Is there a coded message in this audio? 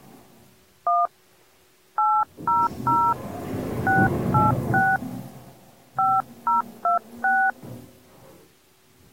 Yes: DTMF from 0.9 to 7.5 s, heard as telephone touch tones, dialled by hand, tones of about 190 ms, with the noise inside a lift. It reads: 1 800 686 5026